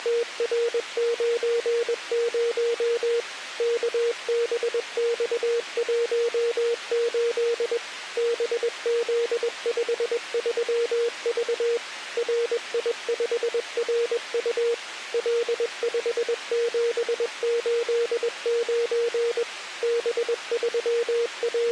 Morse code, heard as a keyed tone, machine-sent, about 21 wpm, 470 Hz. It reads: … KBX18 BZ53V RI5RU L5789 …